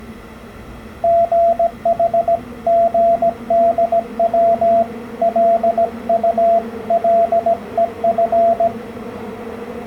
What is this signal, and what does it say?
Morse code (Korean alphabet), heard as a keyed tone, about 17 wpm, 680 Hz, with the noise inside a subway train. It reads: 수습 기간